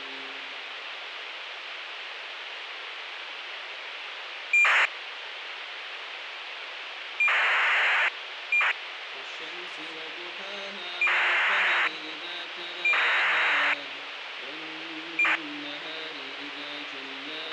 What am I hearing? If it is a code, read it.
ACARS aircraft data, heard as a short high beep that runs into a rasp, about 2400 baud, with radio hiss and a squelch burst at the end.